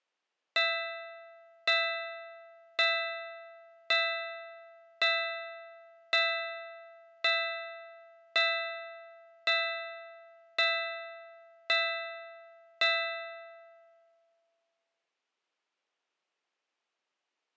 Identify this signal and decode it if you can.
Clock strike, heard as a bell. 12. Twelve o'clock.